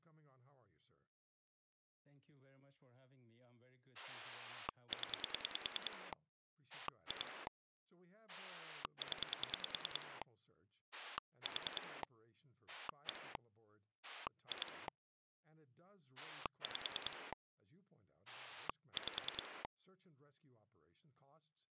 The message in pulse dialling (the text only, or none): 0 2 0 4 1 2 5 5